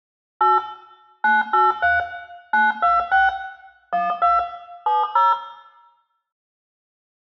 DTMF, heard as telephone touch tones, dialled by machine, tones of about 180 ms, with room echo. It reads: 8 983 926 12 70